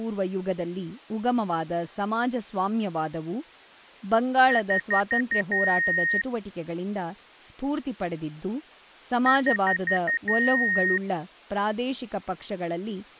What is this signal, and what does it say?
Beep code, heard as beeps from a small speaker, played twice, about 1850 Hz, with speech in Kannada. 5 short, 1 long.